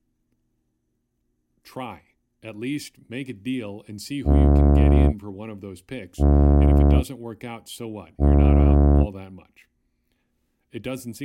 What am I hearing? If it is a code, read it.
Ship horn signal, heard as a ship's horn, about 70 Hz, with speech in English. 3 short. At sea: I am operating astern propulsion.